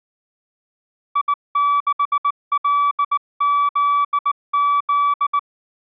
Morse code, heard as a keyed tone, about 19 wpm, 1150 Hz. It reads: I6LZZ